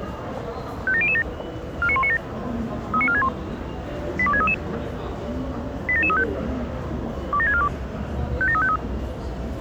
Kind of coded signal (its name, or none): five-tone selective call